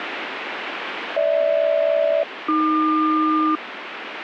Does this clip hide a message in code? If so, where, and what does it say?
Yes: aircraft SELCAL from 1.2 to 3.6 s, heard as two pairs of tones, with radio static. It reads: GH-AQ